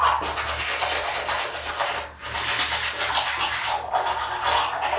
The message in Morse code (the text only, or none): none